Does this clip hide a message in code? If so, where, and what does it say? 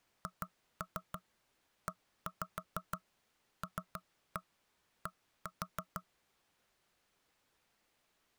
Yes: tap code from 0.3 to 6.1 s, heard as knocks on wood, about 6 knocks a second. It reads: HELD